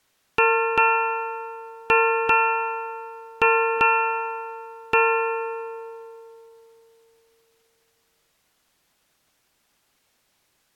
Ship's bell, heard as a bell. 7. Seven half-hours of the watch have passed.